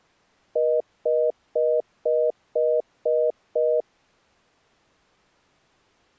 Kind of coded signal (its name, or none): telephone call progress tone